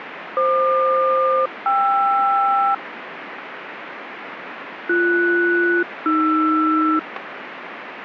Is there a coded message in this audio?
Yes: aircraft SELCAL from 0.4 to 7.0 s, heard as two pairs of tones, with radio static. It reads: FQ-KR BS-AR